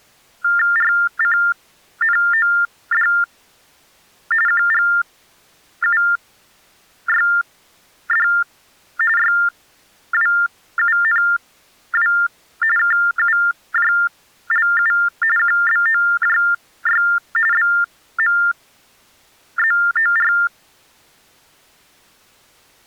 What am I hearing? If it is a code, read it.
TTY/TDD text telephone tones (45.45 baud Baudot), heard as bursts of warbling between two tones, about 400 Hz shift, 1600 Hz centre. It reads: RCNOD QGUYD YWUNW KUJLU QBOJY BMZOR